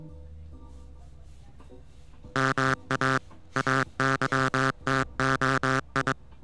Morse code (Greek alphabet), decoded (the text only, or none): ΜΑ ΑΥΤΟΙ